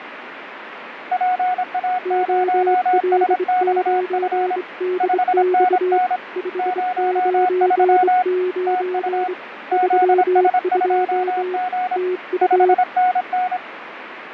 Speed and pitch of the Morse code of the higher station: 26 wpm, 730 Hz

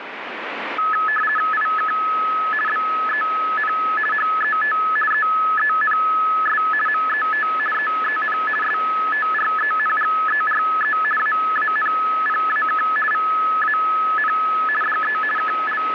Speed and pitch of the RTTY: 50 baud, 450 Hz shift, 1500 Hz centre

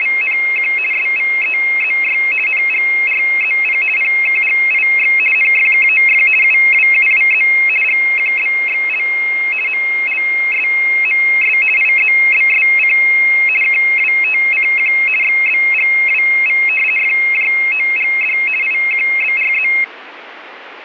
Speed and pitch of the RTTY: 50 baud, 450 Hz shift, 2350 Hz centre

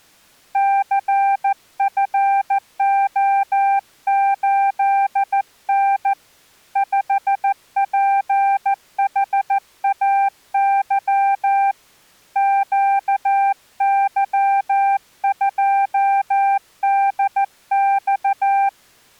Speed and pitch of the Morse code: 14 wpm, 790 Hz

